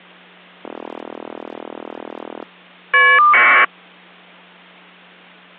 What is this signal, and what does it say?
Caller ID data burst, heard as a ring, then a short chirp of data, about 1200 baud, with hum.